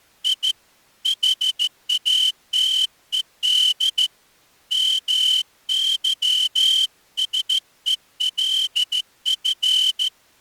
Morse code, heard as a whistle, hand-sent with a straight key, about 14 wpm. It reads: I HATED MYSELF